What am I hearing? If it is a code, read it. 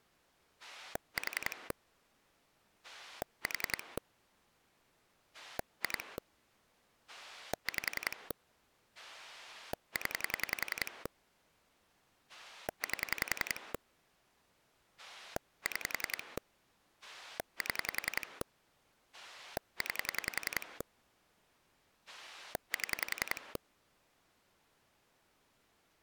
Pulse dialling, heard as a rotary dial, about 10 pulses a second. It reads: 4 4 2 5 0 8 6 7 9 7